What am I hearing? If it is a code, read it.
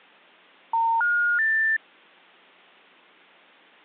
Telephone call progress tone (North American plan), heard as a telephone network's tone, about 910, 1430, 1800 Hz. Special information tone.